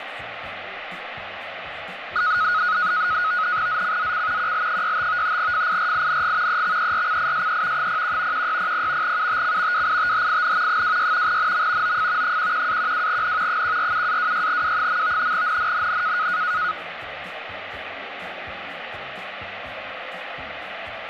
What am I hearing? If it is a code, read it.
NAVTEX (SITOR-B), 100 baud, 170 Hz shift, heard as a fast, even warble, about 1360 Hz centre, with radio static. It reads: ZCZC QL65 FIRING EXERCISE 01 1600 UTC WITHIN 26 NM OF 11-12N 147-26W. NNNN